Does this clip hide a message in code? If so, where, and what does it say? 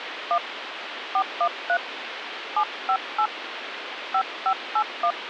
Yes: DTMF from 0.3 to 5.1 s, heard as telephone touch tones, dialled by hand, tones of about 70 ms, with phone line noise. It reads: 1 413 758 5581